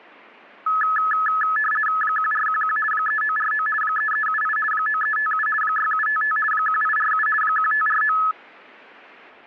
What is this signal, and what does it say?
RTTY (50 baud, 450 Hz shift), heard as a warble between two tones, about 1500 Hz centre. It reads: 1411 3949 3378 9357 6755 1847 1549